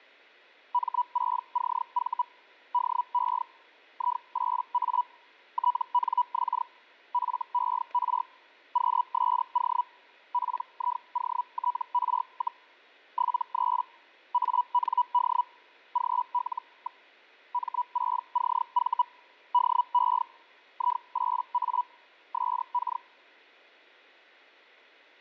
Hellschreiber (Feld-Hell, 122.5 baud), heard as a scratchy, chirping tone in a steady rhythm, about 980 Hz, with static crashes. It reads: M6CV DE I8A TNX FER QSO PIOTR, 73 AND GL. M6CV DE I8A SK